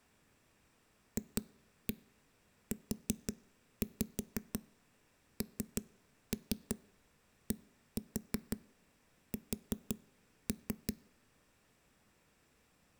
Tap code, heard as knocks on a wall, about 5 knocks a second, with room echo. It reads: FUNDS